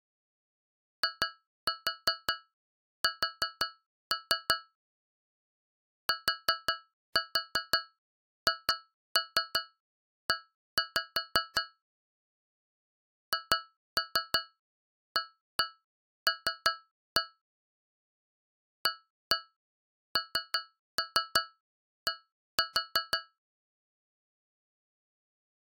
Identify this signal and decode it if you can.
Tap code, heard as taps on a metal pipe, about 5 knocks a second. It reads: IS THE HAL AND